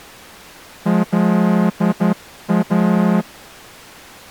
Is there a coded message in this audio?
Yes: Morse code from 0.8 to 3.3 s, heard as a horn, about 10 wpm. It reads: LA